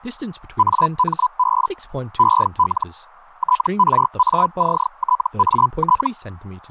Hellschreiber (Feld-Hell, 122.5 baud), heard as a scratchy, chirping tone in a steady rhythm, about 1000 Hz, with speech in English. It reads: AMB EL TRACTAT